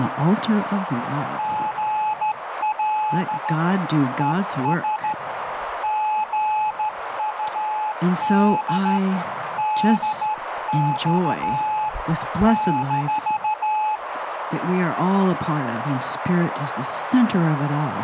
Morse code, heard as a keyed tone, hand-sent with a straight key, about 13 wpm, 860 Hz, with radio static and a narrow filter. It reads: GL ES GUD DX -